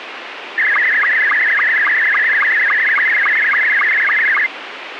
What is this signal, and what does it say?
SSTV (slow-scan television), Scottie S2, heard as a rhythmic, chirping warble, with radio hiss.